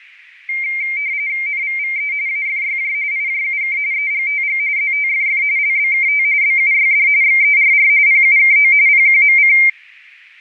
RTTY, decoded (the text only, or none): NVVE AFYJ IJUK EGTG ZTFF LBKT BUYD XERR PUKO PQMC